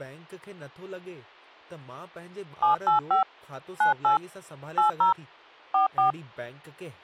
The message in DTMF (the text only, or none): 785 98 80 44